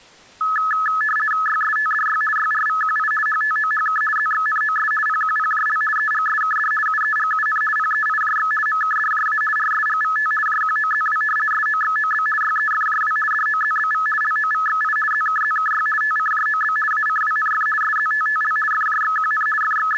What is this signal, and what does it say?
RTTY (50 baud, 450 Hz shift), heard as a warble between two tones, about 1500 Hz centre. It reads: YSTDY YRVQI HTOHK ZXNOS PQPJL EGSKD UEGUN PEIJX MKDJA RSGVT JQOZW SOXOB YEFJW DOZBV LOVXI ZKZKY TCJOB ACWNF SZTTL FJXQN …